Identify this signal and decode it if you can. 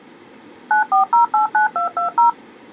DTMF, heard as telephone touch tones, dialled by machine, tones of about 120 ms. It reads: 94089220